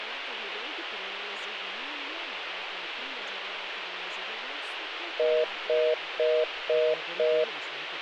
Telephone call progress tone (North American plan), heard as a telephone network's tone, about 480, 620 Hz, 0.25 s on and 0.25 s off, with phone line noise. Congestion tone.